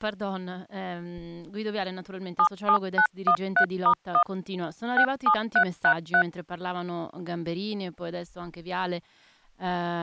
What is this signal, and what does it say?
DTMF, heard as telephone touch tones, dialled by machine, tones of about 80 ms, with speech in Italian. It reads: 77913*1 67333